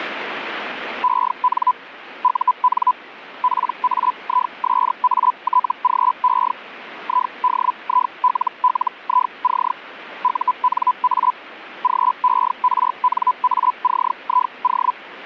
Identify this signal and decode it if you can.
Hellschreiber (Feld-Hell, 122.5 baud), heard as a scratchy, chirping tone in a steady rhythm, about 1000 Hz, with radio static. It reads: EN UN PAISATGE IDILLIC UNA GERNACIO